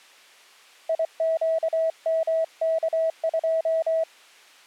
Morse code, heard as a keyed tone, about 24 wpm, 650 Hz. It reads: IQMK2